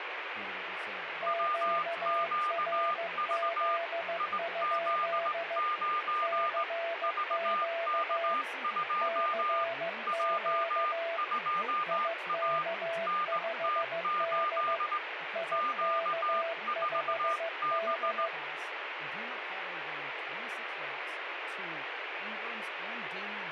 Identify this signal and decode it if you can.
Morse code, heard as two keyed tones, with radio static and speech in English. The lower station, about 15 wpm, 670 Hz: QRZ? CQ CQ IK5D IK5D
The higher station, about 18 wpm, 1210 Hz: WQV IZ9 VK2 J2A NT8 Q4B